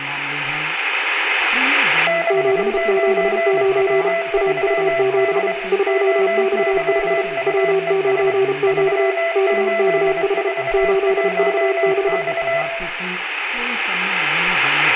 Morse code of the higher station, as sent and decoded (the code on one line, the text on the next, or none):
-.... ----. .-- ...-- -.. / --- -.-- ..- . ... / ...-- ---.. ....- .---- -..-
69W3D OYUES 3841X